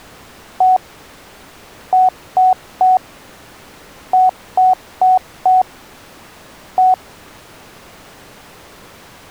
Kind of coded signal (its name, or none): beep code